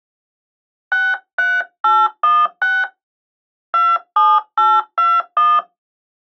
DTMF, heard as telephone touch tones, dialled by hand, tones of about 220 ms. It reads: 63816 27821